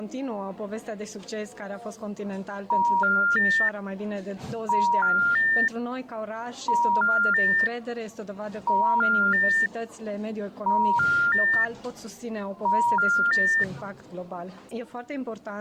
Telephone call progress tone (ITU plan), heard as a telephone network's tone, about 950, 1400, 1800 Hz. Special information tone.